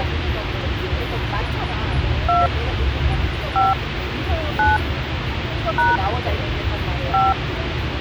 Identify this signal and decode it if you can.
DTMF, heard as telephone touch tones, dialled by hand, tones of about 290 ms, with phone line noise and the noise inside a car. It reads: 2 5 9 # 5